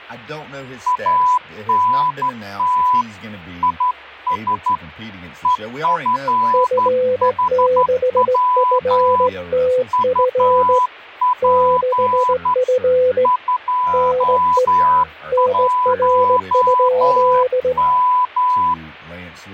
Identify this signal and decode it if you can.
Morse code, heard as two keyed tones, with speech in English. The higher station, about 12 wpm, 1000 Hz: ANT IS EFHW UP 21M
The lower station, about 17 wpm, 510 Hz: F6FTF 6F NE NR?